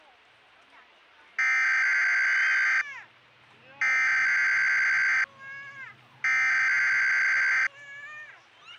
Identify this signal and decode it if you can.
Emergency Alert System (SAME) tones (header bursts), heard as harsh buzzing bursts, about 520.83 baud, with the noise of a park.